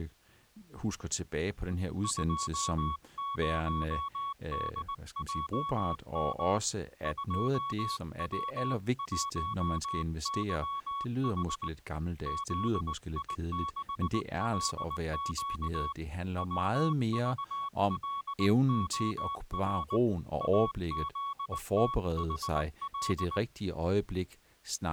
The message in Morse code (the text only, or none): 20DJM 2W1YH ZI6LQ WVLOR AZTHL